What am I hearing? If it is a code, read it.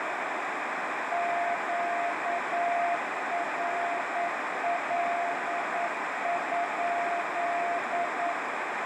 Morse code, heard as a keyed tone, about 9 wpm, 690 Hz, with heavy radio static and a narrow filter. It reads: QRL?